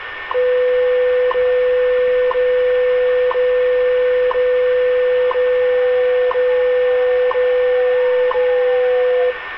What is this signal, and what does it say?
Radio time signal (WWV, Colorado), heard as ticks, one a second, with radio static, a steady whistle near 1800 Hz and street noise.